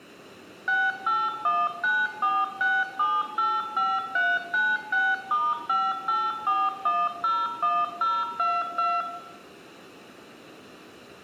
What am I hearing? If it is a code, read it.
DTMF, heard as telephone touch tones, dialled by machine, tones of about 220 ms, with room echo. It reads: 681946785396*584101022